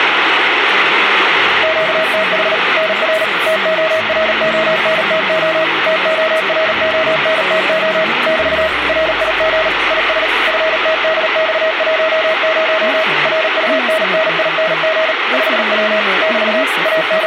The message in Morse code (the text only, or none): QTH NR TORONTO TORONTO <BT> RIG IS FTDX10 RUNNING 5W <BT> …